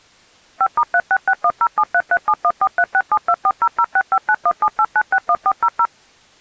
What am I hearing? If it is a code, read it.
DTMF, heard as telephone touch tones, dialled by machine, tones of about 60 ms. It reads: 5*366107337143672400659178961400